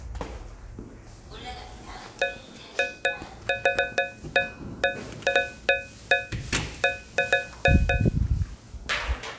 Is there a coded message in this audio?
No, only irregular taps on a metal pipe, with the noise inside a lift.